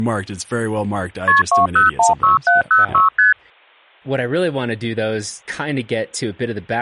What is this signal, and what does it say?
Multi-frequency trunk signalling (R1, as on North American trunks), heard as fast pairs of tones, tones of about 140 ms, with speech in English. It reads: KP 2016706 ST